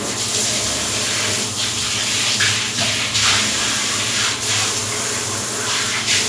The noise of a restroom. There is no code.